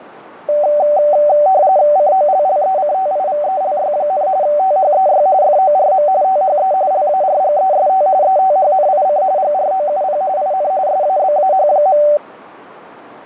RTTY (45.45 baud, 170 Hz shift), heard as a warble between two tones, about 680 Hz centre, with radio static. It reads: COLLECTIVELY, THEY FORM THE LARGEST ETHNIC GROUP IN SABAH.